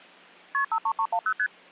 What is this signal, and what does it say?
Multi-frequency trunk signalling (R1, as on North American trunks), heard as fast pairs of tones, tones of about 70 ms. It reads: KP 53310 ST